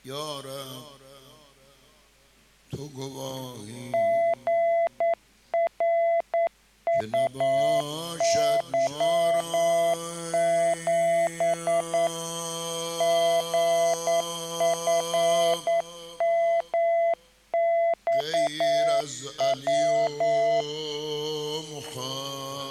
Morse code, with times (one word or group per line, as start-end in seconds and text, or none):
3.9-12.1 GRUY7
13.0-20.6 GFMXW